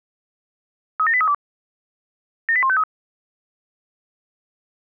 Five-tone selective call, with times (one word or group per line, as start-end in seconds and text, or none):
1.0-1.3 37832
2.5-2.8 78153